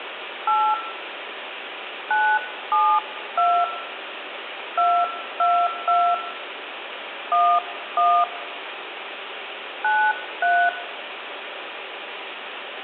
DTMF, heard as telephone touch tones, dialled by hand, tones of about 270 ms, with phone line noise and room echo. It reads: 8 972 222 11 93